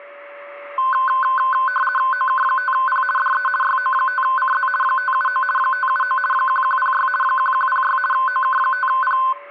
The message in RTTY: OK5P DE YO5CZ 579 579 1106 1106 OK5P

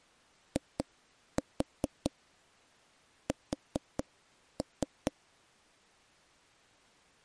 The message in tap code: IS

